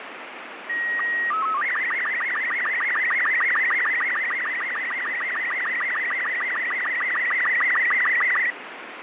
SSTV (slow-scan television), Robot 36, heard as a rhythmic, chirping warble, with radio static.